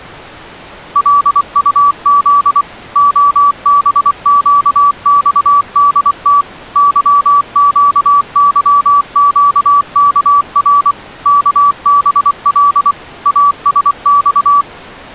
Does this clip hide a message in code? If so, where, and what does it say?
Yes: Morse code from 0.9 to 14.7 s, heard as a keyed tone, machine-sent, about 24 wpm, 1150 Hz. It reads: LUZ OBQXDT YQYQKR KBL ASX